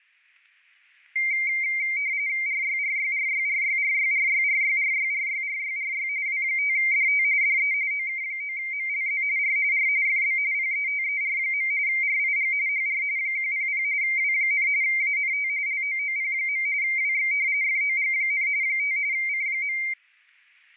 RTTY (45.45 baud, 170 Hz shift), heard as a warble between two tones, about 2200 Hz centre, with static crashes. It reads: RYRYRYRYRYRYRYRYRYRYRY W5DT DE OK9MLZ R R FB PETER. RIG HR 100 W, ANT LOOP. WX FOG, 5 C.